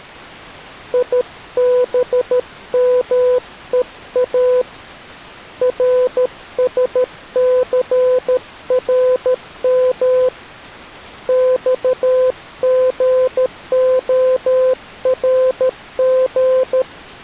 Morse code, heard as a keyed tone, hand-sent with a paddle, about 13 wpm, 510 Hz. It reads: IBMEA RSCRM XGORG